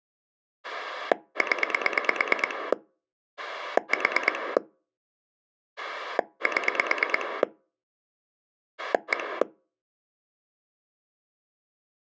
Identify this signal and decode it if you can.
Pulse dialling, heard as a rotary dial, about 9 pulses a second. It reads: 0 4 7 1